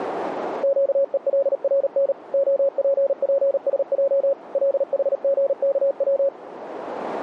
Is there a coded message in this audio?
Yes: Morse code (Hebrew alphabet) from 0.6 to 6.3 s, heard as a keyed tone, machine-sent, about 38 wpm, 550 Hz, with radio static. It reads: קולרן הפפשע לחגכץ